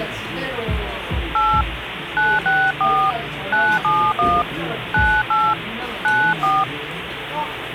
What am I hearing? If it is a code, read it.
DTMF, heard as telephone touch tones, dialled by hand, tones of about 250 ms, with phone line noise and the noise of a cafe. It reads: 8 964 971 98 94